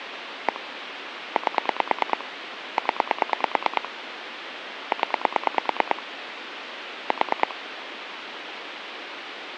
Pulse dialling, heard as clicks on a phone line, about 9 pulses a second, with phone line noise. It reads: 1 8 0 0 4